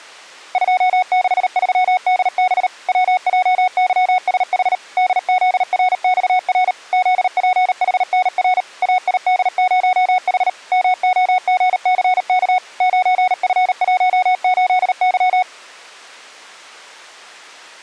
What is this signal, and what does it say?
Morse code, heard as a keyed tone, machine-sent, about 38 wpm, 740 Hz. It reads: 263DB WJYSH DZRXR ZPHNR AID0H MOGCK 9F18Y